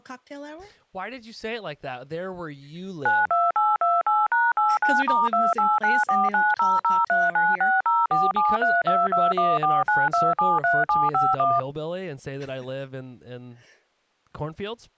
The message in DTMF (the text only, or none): 92828#89*2894900396047322149273751